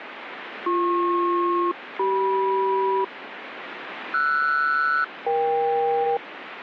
Aircraft SELCAL, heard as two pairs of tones, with radio static. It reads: BP-CM RS-EK